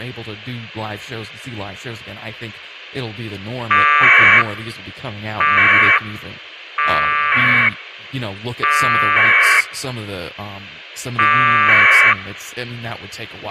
Packet radio (AX.25, as in APRS), 1200 baud, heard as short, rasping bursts, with a squelch burst at the end and speech in English.